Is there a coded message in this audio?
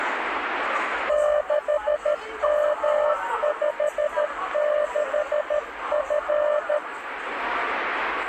Yes: Morse code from 1.0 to 6.8 s, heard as a keyed tone, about 13 wpm, 600 Hz, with radio static and the noise of a cafe. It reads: 6M56F